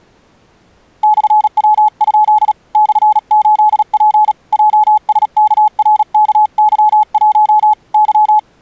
Morse code, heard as a keyed tone, hand-sent with a paddle, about 37 wpm, 850 Hz. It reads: /W? /8P JSKRKY1 Y